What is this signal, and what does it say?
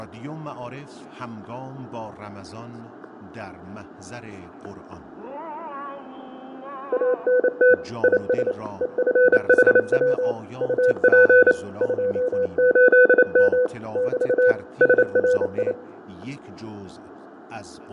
Morse code, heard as a keyed tone, machine-sent, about 28 wpm, 500 Hz, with fading, static crashes and room echo. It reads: ANT IS EFHW UP 28M <BT> SRI